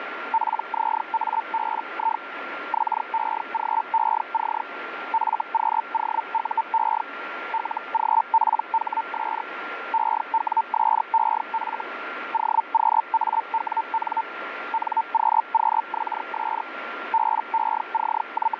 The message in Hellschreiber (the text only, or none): PZABI XEGEC FQOUE LGPHS EWSEF OQAWN NQQXS …